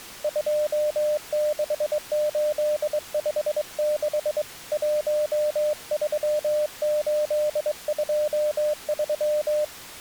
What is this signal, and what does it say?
Morse code, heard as a keyed tone, hand-sent with a straight key, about 22 wpm, 600 Hz. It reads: 26856 13823